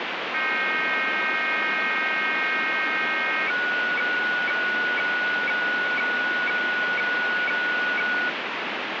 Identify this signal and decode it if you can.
Weather fax (radiofax), 120 lines a minute, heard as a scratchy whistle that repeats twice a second, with heavy radio static.